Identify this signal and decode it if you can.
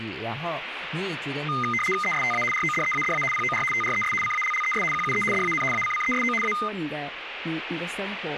RTTY (75 baud, 850 Hz shift), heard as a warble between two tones, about 1650 Hz centre, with radio static and speech in Chinese. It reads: ESTA RODEADA POR TRES CALLES QUE DAN ACCESO A